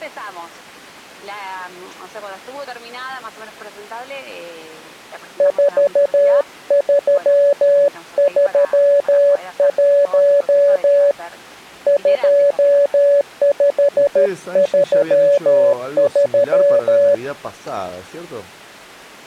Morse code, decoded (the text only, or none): 4331 2533